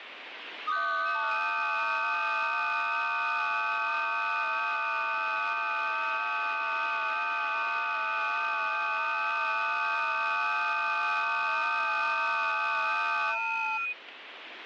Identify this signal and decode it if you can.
FT8 (several signals at once), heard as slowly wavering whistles, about 6.25 baud, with radio static.